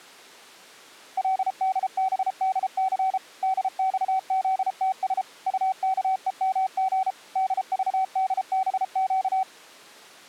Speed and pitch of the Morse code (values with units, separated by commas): 33 wpm, 760 Hz